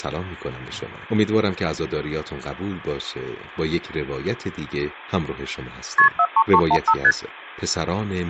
Multi-frequency trunk signalling (R1, as on North American trunks), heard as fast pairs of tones, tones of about 60 ms. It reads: KP 43315 ST